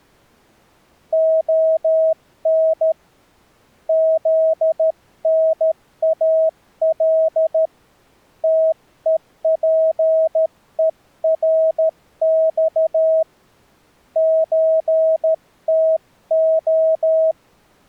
Morse code (Russian alphabet), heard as a keyed tone, hand-sent with a paddle, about 13 wpm, 640 Hz. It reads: ОН ЗНАЛ ТЕПЕРЬ ЧТО